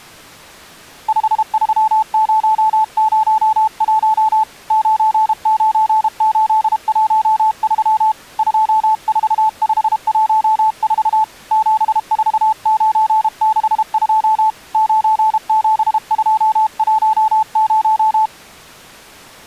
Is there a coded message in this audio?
Yes: Morse code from 1.0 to 18.3 s, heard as a keyed tone, hand-sent with a paddle, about 32 wpm, 870 Hz. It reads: 53001 99813 24514 74962 97210